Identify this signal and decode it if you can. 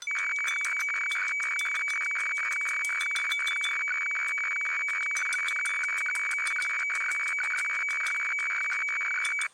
Weather fax (radiofax), 120 lines a minute, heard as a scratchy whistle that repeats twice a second, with kitchen noise.